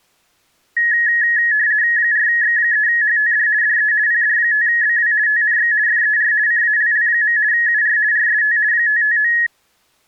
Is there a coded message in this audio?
Yes: RTTY (50 baud, 170 Hz shift) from 0.8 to 9.5 s, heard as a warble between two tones, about 1800 Hz centre. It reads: 4X3HTD DE PD5BW TNX FER CALL. UR RST 559